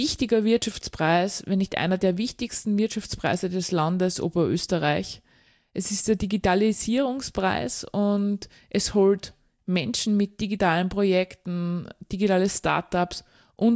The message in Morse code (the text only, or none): none